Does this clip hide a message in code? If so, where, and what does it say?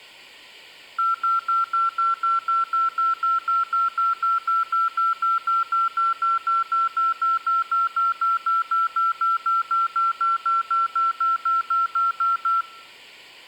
No, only evenly repeated beeps, with room echo.